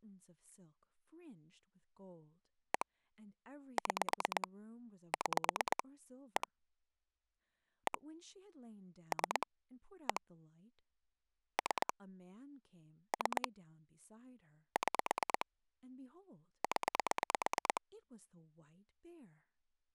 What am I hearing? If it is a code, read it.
Pulse dialling, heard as clicks on a phone line, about 9 pulses a second, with speech in English. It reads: 1 6 6 1 1 3 1 3 3 6 0